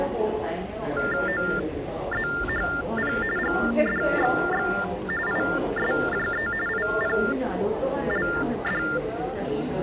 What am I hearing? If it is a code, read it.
TTY/TDD text telephone tones (45.45 baud Baudot), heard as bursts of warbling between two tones, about 400 Hz shift, 1600 Hz centre, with hum and the noise of a crowd indoors. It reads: OZHP GDXX ISJE IPLD